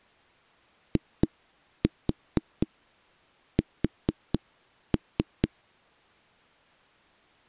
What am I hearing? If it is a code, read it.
Tap code, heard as knocks on a wall, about 4 knocks a second. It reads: IS